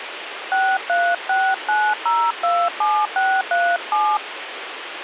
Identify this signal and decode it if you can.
DTMF, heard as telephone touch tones, dialled by hand, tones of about 250 ms, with phone line noise. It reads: 6369027637